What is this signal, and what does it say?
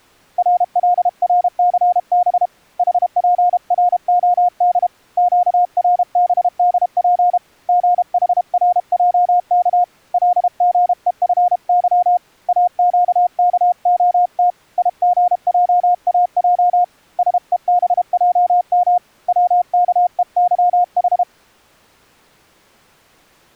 Morse code, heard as a keyed tone, hand-sent with a paddle, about 32 wpm, 710 Hz. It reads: RLRCB HPROD QRBDP GHRJK LGEFY AQKOT IGJAJ SEBJM WKEYH